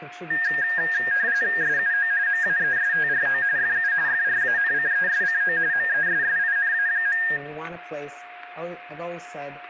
RTTY (45.45 baud, 170 Hz shift), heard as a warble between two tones, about 1700 Hz centre, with static crashes, a steady whistle near 710 Hz, room echo and speech in English. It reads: SUO MAESTRO FU FRANCESCO MESSINA.